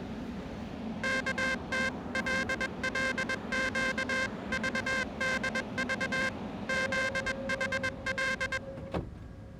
Morse code (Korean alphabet), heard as a buzzer, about 21 wpm, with the noise inside a subway train. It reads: 어깨를 툭